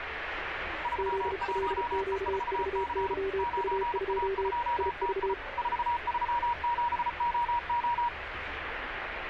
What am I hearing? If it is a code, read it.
Morse code, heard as two keyed tones, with radio static and street noise. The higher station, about 34 wpm, 950 Hz: 31E4C 9A2TI 437OO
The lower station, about 34 wpm, 390 Hz: ZLQVYU2 IV